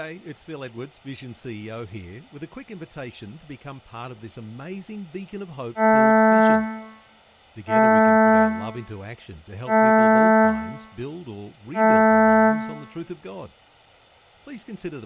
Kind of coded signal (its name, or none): ship horn signal